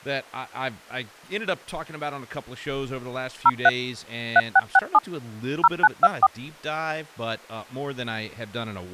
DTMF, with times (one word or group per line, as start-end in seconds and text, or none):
3.5-3.7 03
4.4-5.0 3667
5.6-6.3 0924